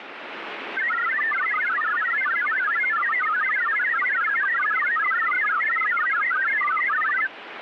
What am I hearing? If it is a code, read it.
Multi-tone FSK (Olivia or MFSK type), about 1000 Hz wide, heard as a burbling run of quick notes, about 62.5 baud, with radio static.